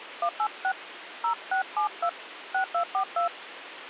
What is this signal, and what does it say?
DTMF, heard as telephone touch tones, dialled by hand, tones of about 100 ms, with phone line noise. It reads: 186 0672 6242